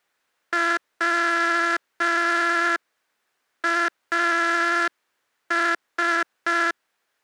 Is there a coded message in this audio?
Yes: Morse code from 0.5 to 6.8 s, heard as a buzzer, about 5 wpm. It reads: WAS